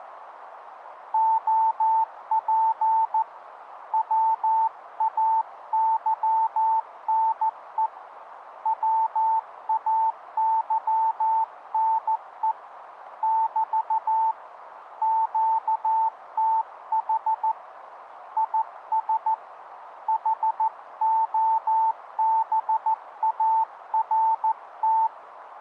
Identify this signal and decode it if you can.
Morse code, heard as a keyed tone, hand-sent with a paddle, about 14 wpm, 890 Hz, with radio static and a narrow filter. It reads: OP WAYNE WAYNE <BT> QTH IS HOBART